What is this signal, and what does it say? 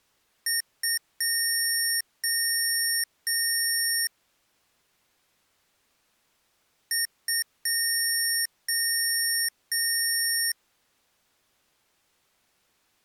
Beep code, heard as beeps from a small speaker, played twice, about 1850 Hz. 2 short, 3 long.